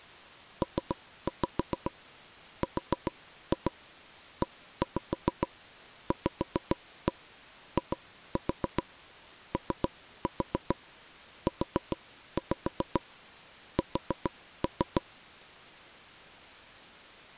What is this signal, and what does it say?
Tap code, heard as taps on a table, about 7 knocks a second. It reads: PREVIOUS